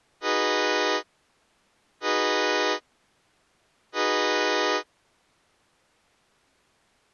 Train horn signal, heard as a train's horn. 3 short. On North American railways: when stopped, the train will back up.